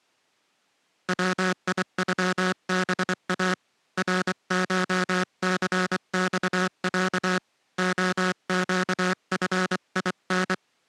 Morse code (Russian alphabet), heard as a buzzer, hand-sent with a paddle, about 24 wpm. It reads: ВИЮБА РШЦЬЯ ОЩФИН